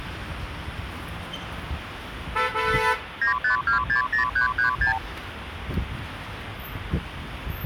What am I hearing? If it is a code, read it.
Multi-frequency trunk signalling (R2, with the far end's replies), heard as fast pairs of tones, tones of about 110 ms, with phone line noise and the noise of a residential street. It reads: 95260336